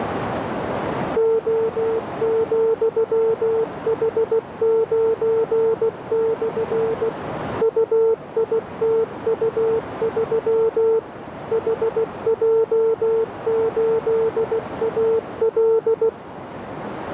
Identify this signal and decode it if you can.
Morse code, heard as a keyed tone, machine-sent, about 16 wpm, 450 Hz, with radio static and a narrow filter. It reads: O,H9/ UITU3 HJ8AL